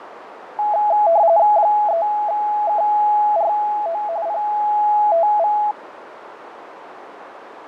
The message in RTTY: 3KRO PTV

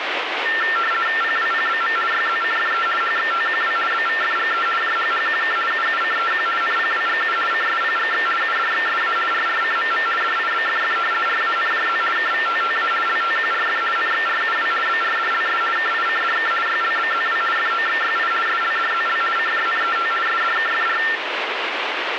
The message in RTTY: PWPBM YZCFE HXTQW BVFGE JHHQK UUCEQ NPWGU CSPGX UDXSA RRCMM DIBFF RANJZ KVTTA LTQRF NXRUW BRDLS KICDK YLBZW FOXYI SLDZL CJNET SDKFR

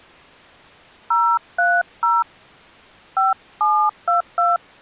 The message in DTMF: 030 5722

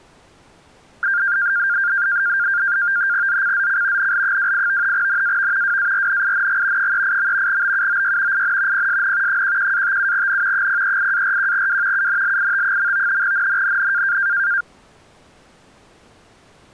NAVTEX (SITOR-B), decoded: ZCZC NL28 NAV WARNING 38. BUOY IN PSN 11-57N 038-41W UNLIT. NNNN

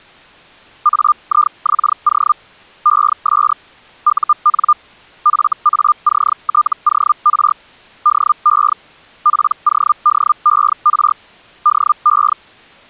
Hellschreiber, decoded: AIXO ES UN FACTOR DE PODER DE

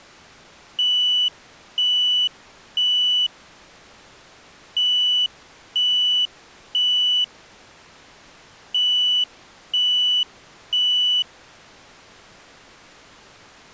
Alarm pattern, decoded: temporal three

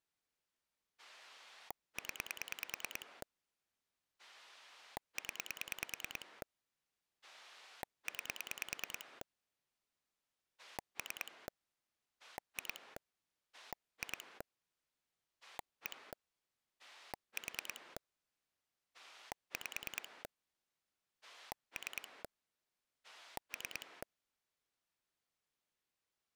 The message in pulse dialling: 0 0 9 3 2 2 1 4 5 3 3

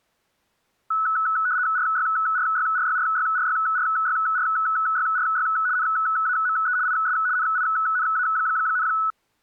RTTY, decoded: RYRYRYRYRYRYRYRY NAME IS NINA,

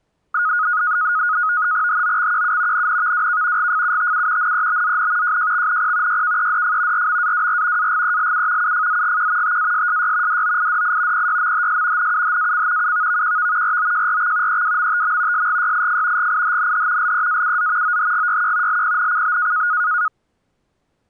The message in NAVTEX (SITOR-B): HOXQU NNVWK GFUTU NEBZN JJXNP YKEDF RMAWR AGELU UFZGQ TASSY DOIDI PYMHS NUHAC UVVQV ROJRX EWMTM SGYIF GIHNH LEAUZ OHGYQ LPNCB

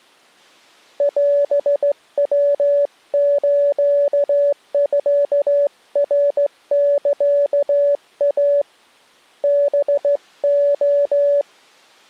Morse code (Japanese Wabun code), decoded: オヤスミナサイ ハレ

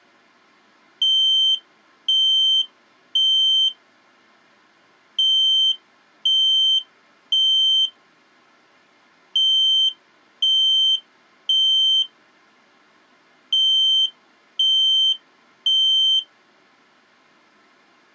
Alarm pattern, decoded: temporal three

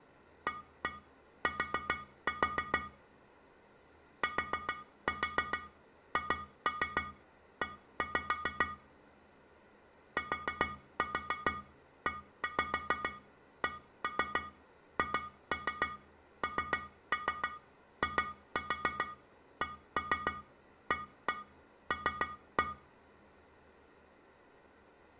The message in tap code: AT THE TECHNICAL

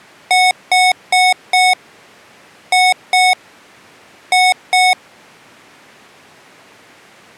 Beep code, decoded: 4-2-2

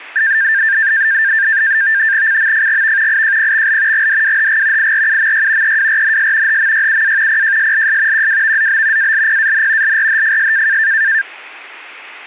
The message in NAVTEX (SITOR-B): CMFGV IJPXL GDWHG IRUMY EWRNS HMYUA PJSLS QWVZB ALPAN LRHFS

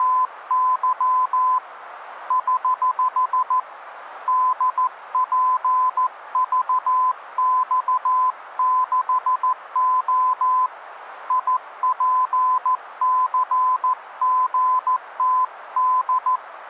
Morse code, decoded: … <HH> DPVX6O IPCGTD

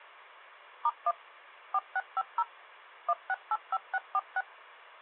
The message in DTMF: *1 4650 1685646

